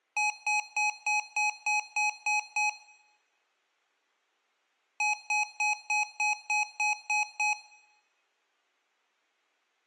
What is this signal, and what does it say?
Beep code, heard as beeps from a small speaker, played twice, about 840 Hz, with room echo. 9 short. In AMI BIOS tables: ROM checksum failure.